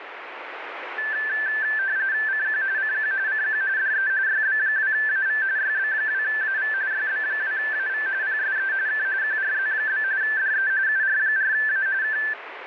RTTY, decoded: CQ CQ CQ DE YB2AV YB2AV YB2AV PSE K QRZ? DE UR4A K

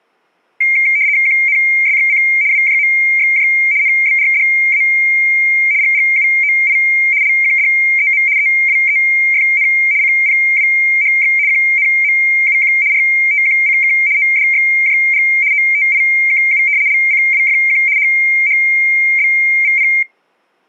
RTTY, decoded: QNSXC WJMXJ NBRDA GGUOI LQDEM EWEFN CPWHX QNMUQ RTQCK ODXJG OTIKU LCWFQ HHBVP

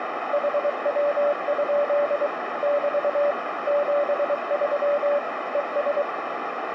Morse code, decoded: HW? <BT> 73 ES

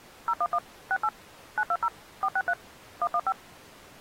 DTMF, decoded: 011 68 920 463 115

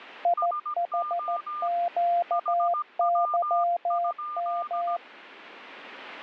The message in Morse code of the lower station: IHQYM

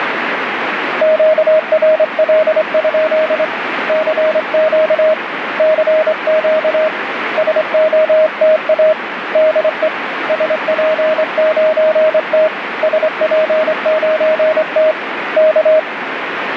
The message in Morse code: QRL? CQ CQ SOTA DE SP9T SP9T K

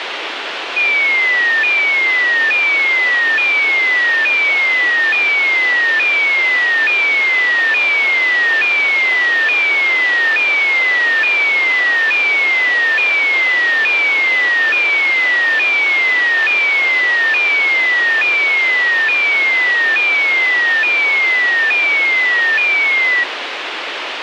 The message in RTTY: none

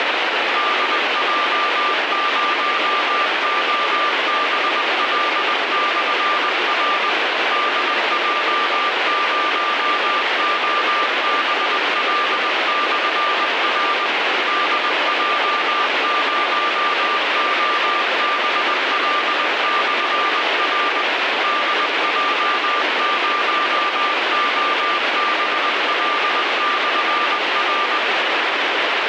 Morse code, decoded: DJ0OBL/R DJ0OBL/R DJ0OBL/R DJ0OBL/R

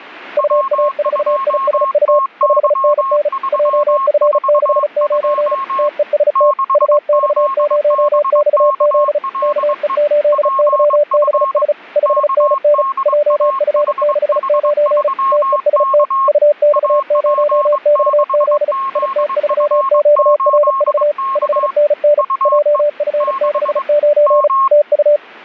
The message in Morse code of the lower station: UA4ISU 5NN JF69 TEST UX0XZ KE8YBS 5NN JF69 TEST UX0XZ IT3QRV 5NN JF69 TU

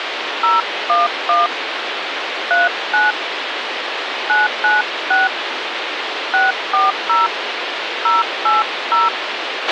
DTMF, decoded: 011 39 996 640 080

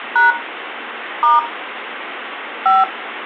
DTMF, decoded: # * 5

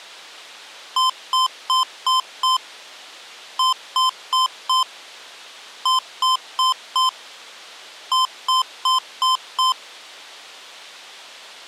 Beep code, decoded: 5-4-4-5

